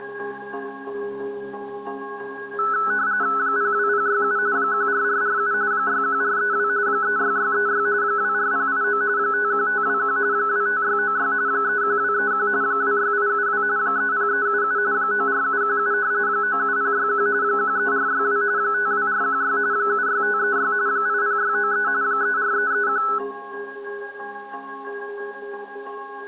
RTTY (45.45 baud, 170 Hz shift), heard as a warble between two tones, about 1400 Hz centre. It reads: 02067 14447 61432 36636 24089 51521 25696 31231 26872 30377 94717 97061 13462 52416 76536 80693 34331